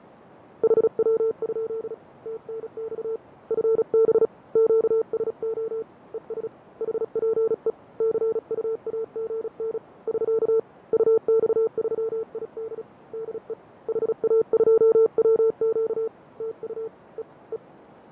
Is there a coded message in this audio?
Yes: Morse code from 0.6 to 17.6 s, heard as a keyed tone, hand-sent with a paddle, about 36 wpm, 450 Hz, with radio static, fading and a narrow filter. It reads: HW? TNX FB QSO ES HPE CUAGN <SK> UX3ID DE HA2WQ TU E E